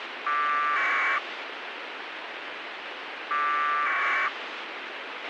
Packet radio (AX.25, as in APRS), 1200 baud, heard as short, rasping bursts, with radio hiss and a squelch burst at the end.